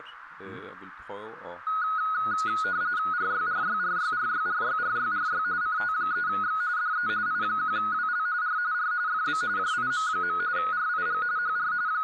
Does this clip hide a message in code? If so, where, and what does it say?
Yes: RTTY (45.45 baud, 170 Hz shift) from 1.7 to 12.0 s, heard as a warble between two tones, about 1360 Hz centre, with radio static and speech in Danish. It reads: RYRYRYRYRYRYRY CT3X DE I1WL R R FB JIM. RIG HR …